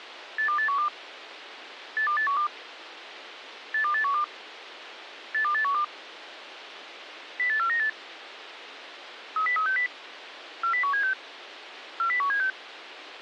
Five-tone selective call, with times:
0.4-0.9 82812
2.0-2.5 82812
3.7-4.2 82812
5.3-5.8 82812
7.4-7.9 08498
9.4-9.9 30360
10.6-11.1 40176
12.0-12.5 40176

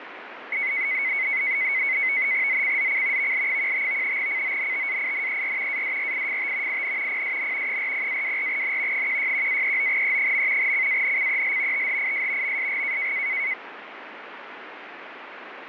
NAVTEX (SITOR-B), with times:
2.5-3.3 ZCZC
3.2-4.2 VL15
4.2-5.8 CONTAINER
5.7-6.8 ADRIFT
6.7-7.2 IN
7.1-7.8 PSN
7.7-9.1 40-24N
8.9-10.7 161-39E.
10.6-11.9 CANCEL
11.7-12.6 THIS
12.4-13.1 MSG

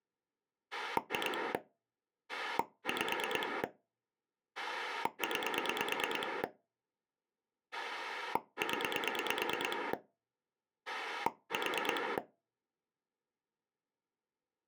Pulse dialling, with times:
0.7-1.5 2
2.3-3.6 5
4.6-6.4 9
7.7-9.9 0
10.9-12.2 4

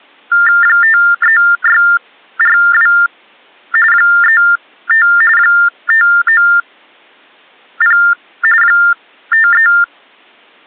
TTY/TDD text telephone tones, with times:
0.6-2.9 53642
3.9-5.1 35
5.4-8.0 590
8.6-9.7 53

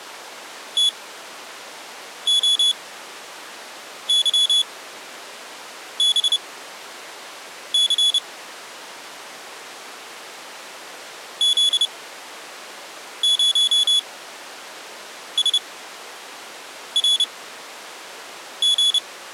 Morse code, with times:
0.8-8.2 TOYBC
11.4-19.0 Z0SRG

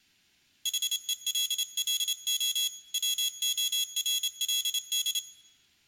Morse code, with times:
0.7-2.7 HELLO
2.9-5.2 WORLD

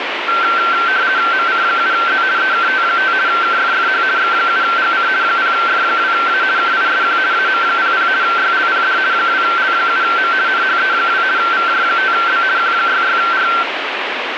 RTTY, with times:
1.3-2.2 MC7Z
2.4-3.1 EKT5
3.3-4.0 KFFH
4.2-5.1 X7GC
5.2-6.4 0F2A
6.6-7.2 KISQ
7.3-8.1 AM00
8.2-9.0 YLPD
9.1-10.3 2L7M
10.5-11.2 NHE2
11.4-12.4 VJ5B
12.6-13.5 Q66R

